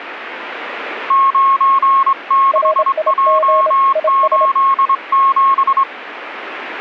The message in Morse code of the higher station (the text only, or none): 96J87